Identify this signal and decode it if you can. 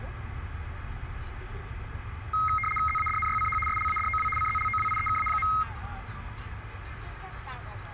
RTTY (75 baud, 850 Hz shift), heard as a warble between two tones, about 1700 Hz centre, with radio static and the noise inside a car. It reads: ZADNYCH SLADOW CZLOWIEKA.